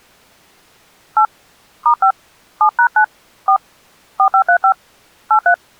DTMF, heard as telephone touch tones, dialled by hand, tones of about 80 ms. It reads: 8 *5 7#9 4 4535 83